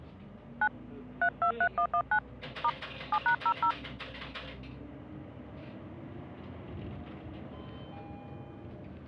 DTMF, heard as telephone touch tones, dialled by hand, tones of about 70 ms, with the noise inside a bus. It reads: 9 323119 * 7#00